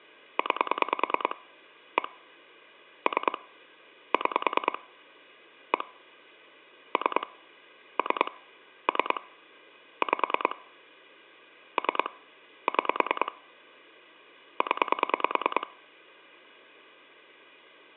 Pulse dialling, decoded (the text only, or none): 9 1 3 6 1 3 3 3 5 3 6 0